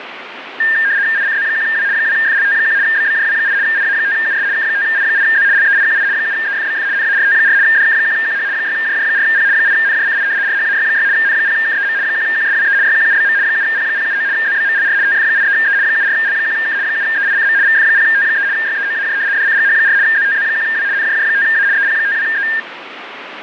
RTTY (75 baud, 170 Hz shift), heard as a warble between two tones, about 1700 Hz centre, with radio static. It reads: ICZ1W 2FLT1 BBJW8 IA5US K5I8Z LEIQI 7EFBF NART4 DK1QH 6JJ4P 8NJCI RHAY6 N0KEM 1QSWE YQUBM 7P079 ZBMLR TF83E 74L1K 7EICM VF0T3 YEOAJ DCGH4 ZTZ1W NJJ5A EP52E